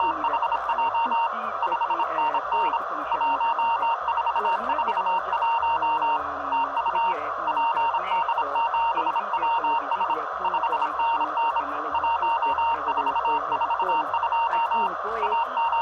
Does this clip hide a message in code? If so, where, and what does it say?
Yes: Morse code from 0.0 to 15.8 s, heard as a keyed tone, hand-sent with a bug key, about 26 wpm, 920 Hz, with radio static. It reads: … 5NN 1441 TU PD7WS 5NN 1442 …